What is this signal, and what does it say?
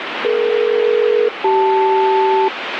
Aircraft SELCAL, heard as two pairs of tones, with radio static. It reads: DE-CL